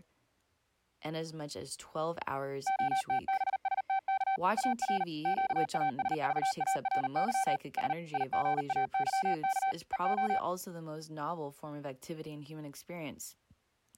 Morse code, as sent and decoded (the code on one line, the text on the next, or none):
--- - -... ... - -.- / .- .-. / --.- .- ... ...- .- .-. -.-- / ... / .. --. .- -.-- -.- / . ---
OTBSTK AR QASVARY S IGAYK EO